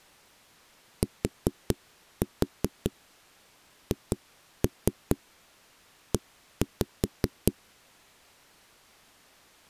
Tap code, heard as knocks on a wall, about 5 knocks a second. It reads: THE